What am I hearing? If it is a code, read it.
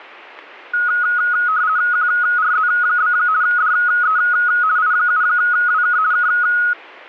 RTTY (50 baud, 170 Hz shift), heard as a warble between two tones, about 1360 Hz centre. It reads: QRZ? DE I7WK K